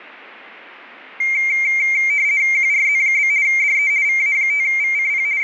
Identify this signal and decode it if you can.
RTTY (50 baud, 170 Hz shift), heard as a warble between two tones, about 2200 Hz centre, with radio static. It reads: QRZ? DE VA5VCP …